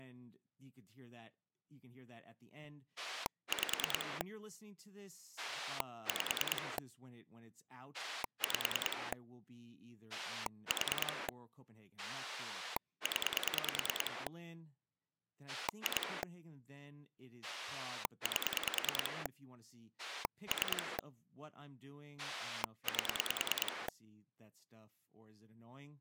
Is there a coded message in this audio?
Yes: pulse dialling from 3.0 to 23.9 s, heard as a rotary dial, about 10 pulses a second, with speech in English. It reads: 5 5 5 4 0 2 8 3 8